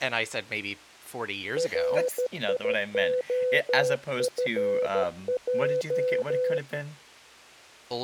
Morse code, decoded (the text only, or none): RIOFJ